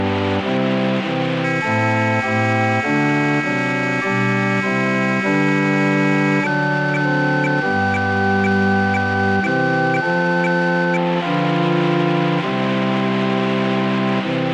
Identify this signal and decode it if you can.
Weather fax (radiofax), 120 lines a minute, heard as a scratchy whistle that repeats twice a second, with radio static.